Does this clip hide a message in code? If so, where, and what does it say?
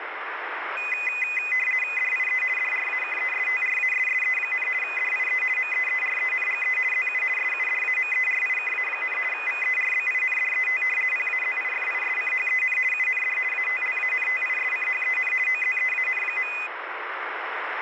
Yes: RTTY (50 baud, 450 Hz shift) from 0.8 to 16.7 s, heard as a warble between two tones, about 2250 Hz centre, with radio static. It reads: DIE DRAKESTRASSE, DIE MEERENGE ZU SUDAMERIKA, VERBINDET PAZIFISCHEN UND ATLANTISCHEN OZEAN.